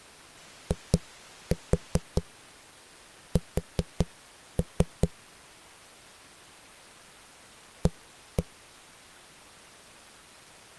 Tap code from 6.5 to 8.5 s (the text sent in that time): A